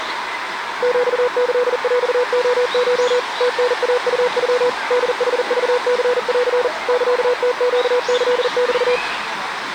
Morse code (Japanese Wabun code), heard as a keyed tone, machine-sent, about 40 wpm, 490 Hz, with the noise of a park. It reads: ヒキヰレコ ムタイウノ ホヌクニン サムネキメ